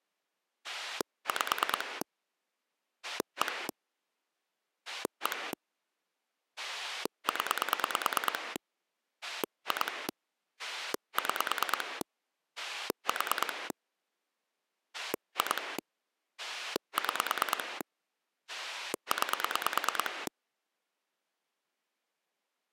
Pulse dialling, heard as a rotary dial, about 9 pulses a second. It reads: 5 1 1 0 2 6 4 2 6 9